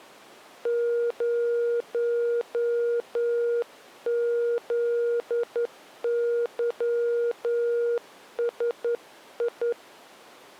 Morse code, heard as a keyed tone, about 10 wpm, 470 Hz. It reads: 0ZYSI